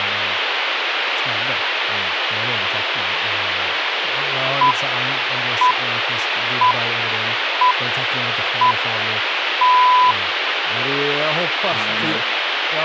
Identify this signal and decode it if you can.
Radio time signal (six pips, as the Greenwich Time Signal), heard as pips, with radio hiss and speech in Swedish.